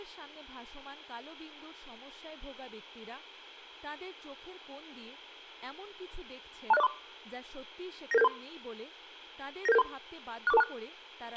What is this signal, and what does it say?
Five-tone selective call (EIA), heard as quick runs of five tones, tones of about 30 ms, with a squelch burst at the end and speech in Bangla. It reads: 26043 99773 99773 64426